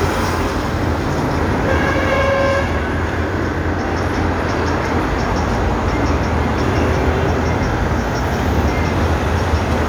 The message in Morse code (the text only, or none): none